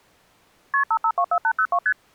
Multi-frequency trunk signalling (R1, as on North American trunks), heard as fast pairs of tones, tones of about 70 ms. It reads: KP 5524802 ST